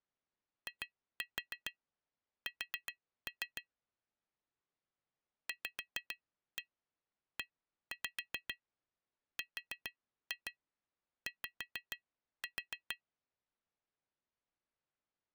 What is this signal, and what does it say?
Tap code, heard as taps on glass, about 6 knocks a second. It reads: IS VERY